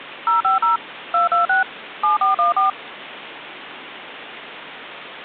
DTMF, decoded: 050 226 7414

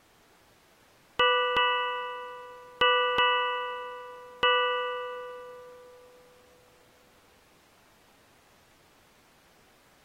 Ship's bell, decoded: 5

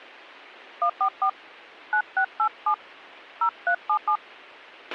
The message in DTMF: 144 9687 0377

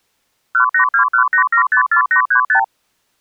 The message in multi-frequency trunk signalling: 18218754835

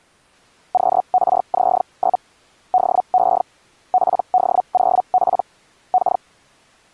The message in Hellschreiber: QRZ? DE PD0P K

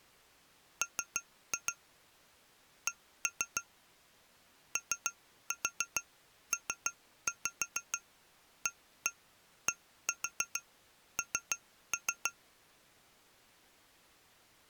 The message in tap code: M C OPADN

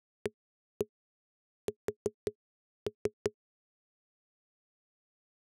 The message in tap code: AS

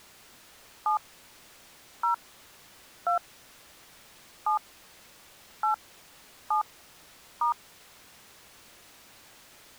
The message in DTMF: 7 0 2 7 8 7 *

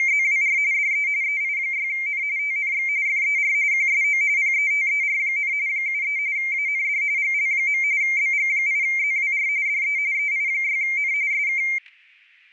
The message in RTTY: … DE EI6N TNX FER QSO PETER, 73 AND GL. BG8ZWR DE EI6N SK

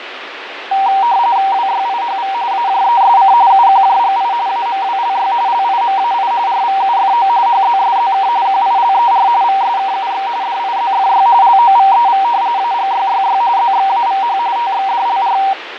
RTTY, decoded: WYIHV AJESC UQJGI AMWLY LIMAI RVUFO HZSZK QILER VSKUX DIZFY LOVEV AGYYY ZXAVH TXDLR

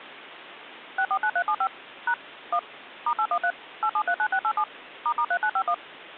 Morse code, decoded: none

